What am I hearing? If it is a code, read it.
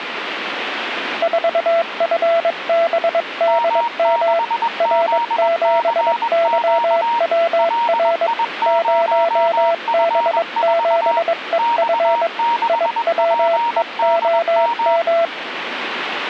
Morse code, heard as two keyed tones, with radio static. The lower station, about 22 wpm, 670 Hz: 4FBDM R7YWR 0B7EF IWEOM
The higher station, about 21 wpm, 940 Hz: M6ZCQ LI0F4 X6PDM